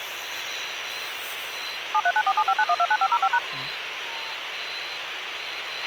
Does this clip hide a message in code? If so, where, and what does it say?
Yes: DTMF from 1.9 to 3.4 s, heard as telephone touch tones, dialled by machine, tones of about 60 ms, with radio hiss and a squelch burst at the end. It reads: 7394759129505#